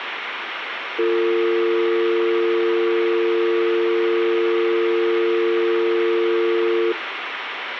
Telephone call progress tone (North American or UK plan), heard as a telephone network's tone, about 350, 450 Hz, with phone line noise. Dial tone.